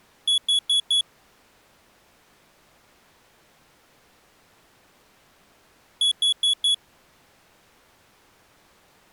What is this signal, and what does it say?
Alarm pattern, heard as an alarm's beeps, played twice, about 3400 Hz. Temporal four. Carbon monoxide.